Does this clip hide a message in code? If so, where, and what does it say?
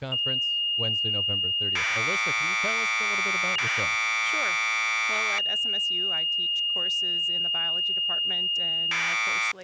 Yes: Commodore tape loading (standard loader) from 0.1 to 9.5 s, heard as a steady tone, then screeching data, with speech in English.